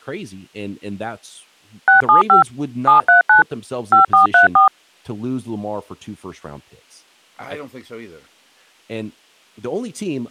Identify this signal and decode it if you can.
DTMF, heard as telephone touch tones, dialled by machine, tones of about 130 ms, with speech in English. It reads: 675 739 5434